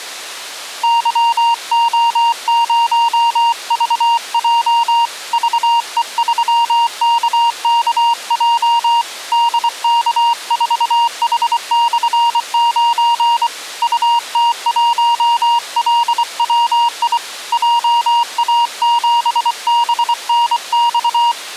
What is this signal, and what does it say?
Morse code, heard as a keyed tone, hand-sent with a paddle, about 24 wpm, 940 Hz. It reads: YO0VJ VE3KKJ DK4H/9 UT1LWI JA7BNX